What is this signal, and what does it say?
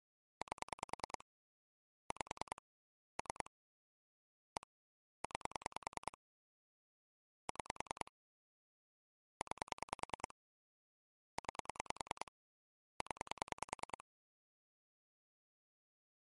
Pulse dialling, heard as clicks on a phone line, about 10 pulses a second. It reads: 8 5 3 1 9 6 9 9 0